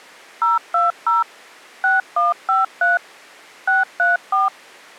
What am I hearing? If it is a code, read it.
DTMF, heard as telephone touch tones, dialled by machine, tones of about 160 ms. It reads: 020 6153 634